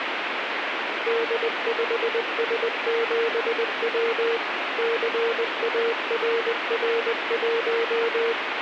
Morse code, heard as a keyed tone, machine-sent, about 20 wpm, 460 Hz, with radio static. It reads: D5S7W CARR1